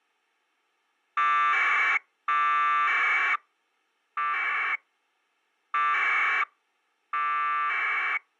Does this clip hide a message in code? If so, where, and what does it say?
Yes: packet radio (AX.25, as in APRS), 1200 baud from 1.2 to 8.2 s, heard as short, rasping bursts.